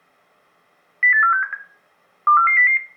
Five-tone selective call (CCIR), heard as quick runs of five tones, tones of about 100 ms, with room echo. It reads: 08467 24400